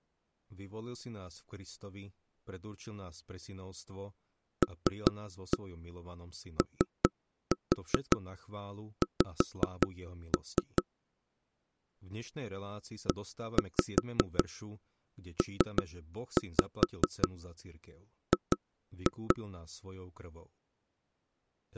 Tap code, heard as knocks on wood, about 5 knocks a second, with speech in Slovak. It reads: LOX EPG